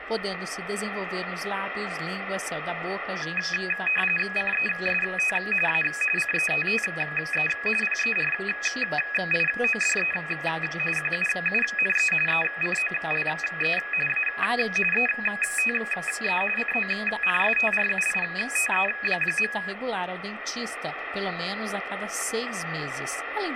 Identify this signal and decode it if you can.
RTTY (45.45 baud, 850 Hz shift), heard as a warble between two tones, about 2100 Hz centre, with radio static. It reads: CEST A CETTE PERIODE QUUNE ECOLE A ETE CONSTRUITE.